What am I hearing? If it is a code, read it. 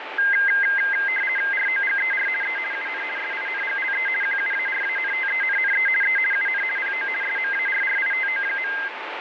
RTTY (50 baud, 450 Hz shift), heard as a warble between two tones, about 1850 Hz centre, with radio static and a steady whistle near 880 Hz. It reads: ROGER E UN SINGLE QUARANTENNE E UN PO SMARRITO.